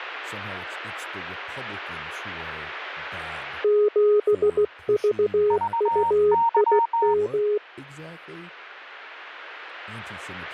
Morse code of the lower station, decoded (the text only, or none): 7VUIM